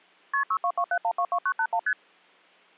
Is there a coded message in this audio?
Yes: multi-frequency trunk signalling (R1, as on North American trunks) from 0.3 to 1.9 s, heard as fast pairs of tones, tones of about 70 ms. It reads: KP 6227122981 ST